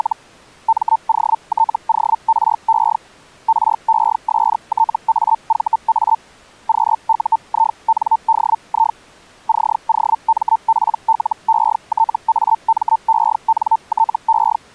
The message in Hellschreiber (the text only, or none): … MOTORE RESTAVA QUINDI COMPLETAMENTE